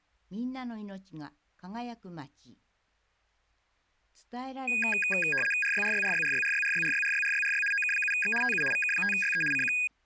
RTTY (75 baud, 850 Hz shift), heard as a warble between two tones, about 2050 Hz centre. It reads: RYRYRYRYRYRYRYRYRYRY OK7X TU VK5YE CQ